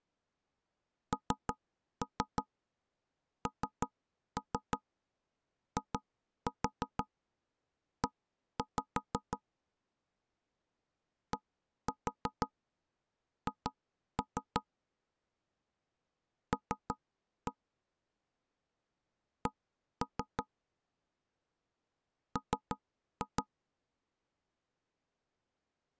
Tap code, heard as knocks on wood, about 6 knocks a second. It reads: NNIE DH L C M